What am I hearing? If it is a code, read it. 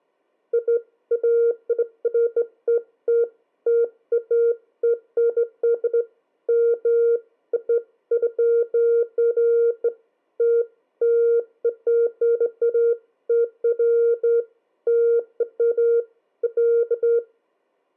Beeps of irregular length. There is no code.